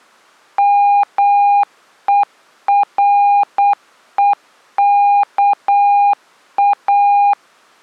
Morse code, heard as a keyed tone, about 8 wpm, 810 Hz. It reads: MEREKA